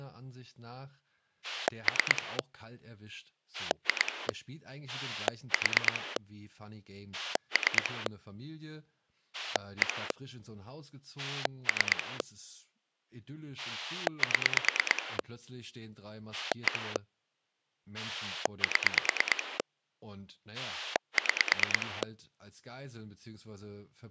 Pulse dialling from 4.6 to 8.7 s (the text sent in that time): 4 3